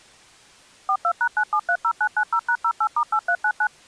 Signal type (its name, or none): DTMF